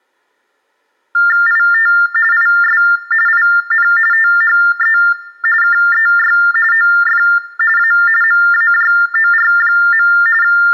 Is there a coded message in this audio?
Yes: TTY/TDD text telephone tones (45.45 baud Baudot) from 1.1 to 10.7 s, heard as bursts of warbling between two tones, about 400 Hz shift, 1600 Hz centre, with room echo. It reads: IT IS IN THE KEY OF A MAJOR. …